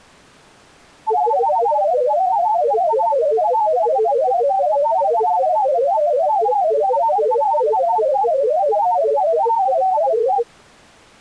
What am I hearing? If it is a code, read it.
Multi-tone FSK (Olivia or MFSK type), about 500 Hz wide, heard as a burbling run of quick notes, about 31.25 baud.